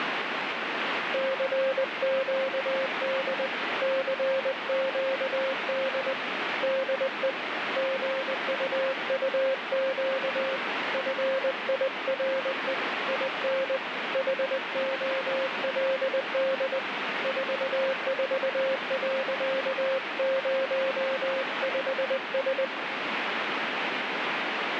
Morse code, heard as a keyed tone, hand-sent with a paddle, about 20 wpm, 530 Hz, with heavy radio static. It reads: CQD CQD DE GUUQ FIRE IN HOLD 44.05S